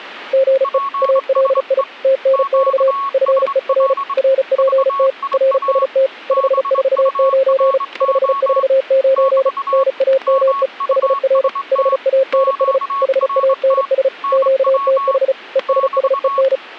Morse code, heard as two keyed tones, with static crashes. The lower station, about 35 wpm, 530 Hz: GE ALI TNX FER RPT RST 549 549 NAME HR HANS HANS QTH ESSEN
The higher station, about 24 wpm, 1110 Hz: PSE QSL VIA BURO <BT> MUST QRT NW <BT>